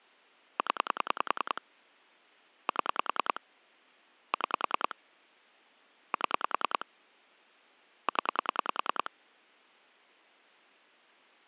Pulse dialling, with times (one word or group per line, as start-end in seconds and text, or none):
0.6-1.6 0
2.7-3.4 7
4.3-4.9 6
6.1-6.8 7
8.1-9.1 0